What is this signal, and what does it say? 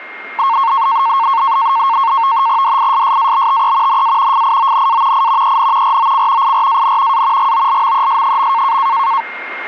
NAVTEX (SITOR-B), 100 baud, 170 Hz shift, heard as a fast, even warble, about 1000 Hz centre, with radio static and a steady whistle near 2120 Hz. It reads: DISSABTE NA FIONA I EN ROC IRAN A GOLMES.